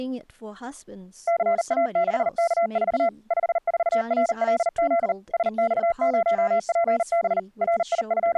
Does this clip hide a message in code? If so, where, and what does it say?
Yes: Morse code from 1.2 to 8.4 s, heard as a keyed tone, machine-sent, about 39 wpm, 680 Hz, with speech in English. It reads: CA6K4 54RLZ SX0PB …